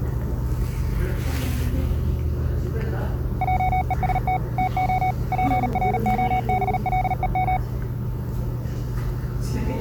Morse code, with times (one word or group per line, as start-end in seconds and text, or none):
3.4-4.4 JEST
4.6-5.1 TO
5.3-7.6 PROBLEM